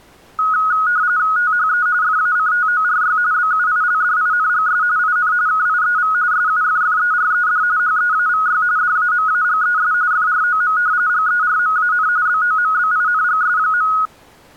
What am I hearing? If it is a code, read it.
RTTY (45.45 baud, 170 Hz shift), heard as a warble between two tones, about 1360 Hz centre. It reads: THE FACTORY BUILDINGS IN KIEV SUFFERED HEAVY DAMAGES FROM GERMAN BOMBINGS.